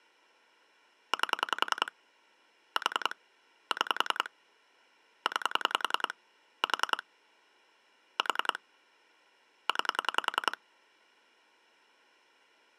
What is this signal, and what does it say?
Pulse dialling, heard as clicks on a phone line, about 10 pulses a second. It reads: 8 4 6 9 4 4 9